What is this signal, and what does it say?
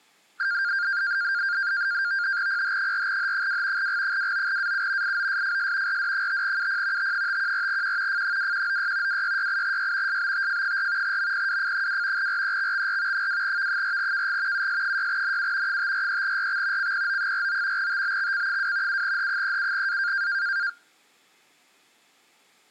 NAVTEX (SITOR-B), 100 baud, 170 Hz shift, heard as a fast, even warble, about 1500 Hz centre. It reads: PH4H2 G29AU IOSFS RD5UP T514Q F2196 2668Y SBTF4 MPWF2 REXXR 2V4KG US6NU 543RX CPO49 TBXC2 7H37A